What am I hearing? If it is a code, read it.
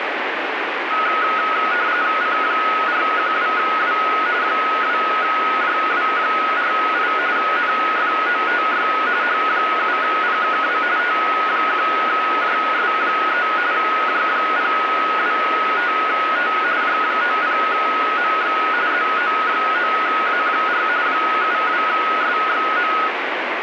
RTTY (45.45 baud, 170 Hz shift), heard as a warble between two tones, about 1360 Hz centre, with radio static. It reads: C412W 2JW48 NFOTY H7PKW T1JS3 J025T J90MX ZO9A4 72SXM